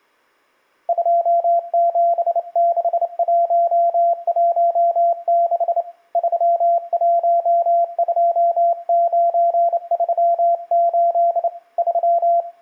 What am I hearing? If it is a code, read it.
Morse code, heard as a keyed tone, hand-sent with a straight key, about 28 wpm, 690 Hz, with room echo. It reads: 276116 312938 3